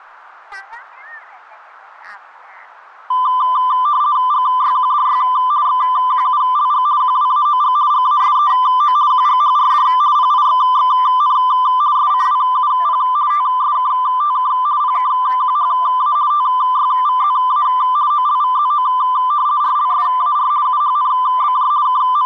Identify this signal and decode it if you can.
RTTY (50 baud, 170 Hz shift), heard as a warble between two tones, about 1100 Hz centre. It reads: GYQDY XQULG QWAOG GASEO QGHRD PIXXN SCWUP TSKTK PKQHA TYVZA OLVZO RLSAR UHNBJ …